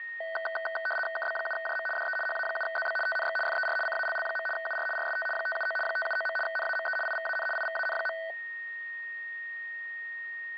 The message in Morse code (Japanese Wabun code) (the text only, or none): none